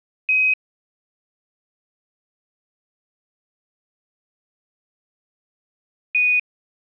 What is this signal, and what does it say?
Quindar tones, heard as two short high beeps.